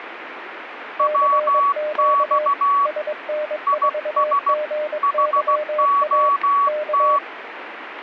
Morse code, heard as two keyed tones, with radio static. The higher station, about 16 wpm, 1130 Hz: WX IS HOT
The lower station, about 22 wpm, 600 Hz: CQ SN4GYA K